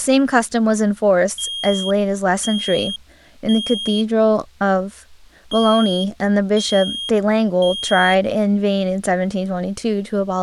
Alarm pattern, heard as an alarm's beeps, played twice, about 3250 Hz, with speech in English. Temporal three. Smoke or fire, evacuate.